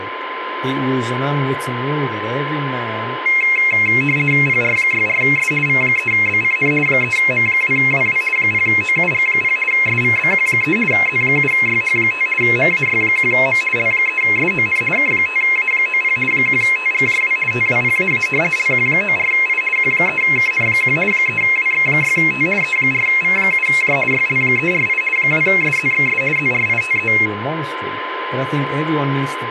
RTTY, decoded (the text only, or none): PR64S V3BCN 3M2WW 0OUG0 SVBQ3 Z7YH5 MAY1M L3SON K5A90 1TGJW TWPAA LQ94I Q3KN1 3WX6T E4V7J YL348 2SZXS ZRITE